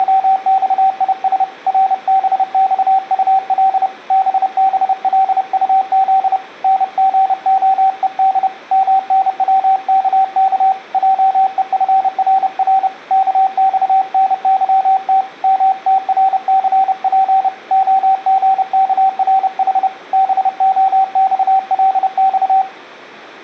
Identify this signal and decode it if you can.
Morse code, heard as a keyed tone, hand-sent with a paddle, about 30 wpm, 770 Hz, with room echo. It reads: … RBXUL BBLUZ NGOED MNWKK JEFRR KXNYT MTRCP OGKRH BOXLX